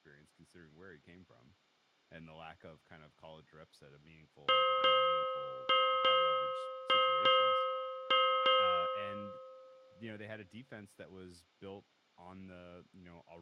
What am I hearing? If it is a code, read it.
Ship's bell, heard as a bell, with room echo and speech in English. 8. Eight half-hours of the watch have passed.